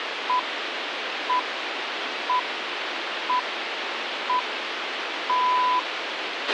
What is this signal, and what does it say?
Radio time signal (six pips, as the Greenwich Time Signal), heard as pips, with radio hiss and a squelch burst at the end.